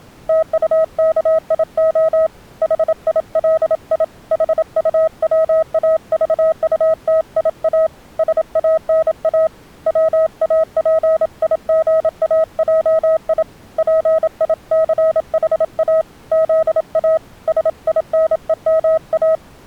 Morse code, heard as a keyed tone, hand-sent with a paddle, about 27 wpm, 640 Hz. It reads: TUKIO HILI HUWAVUTIA SANA WAPIGAJI PICHA ZA SINEMA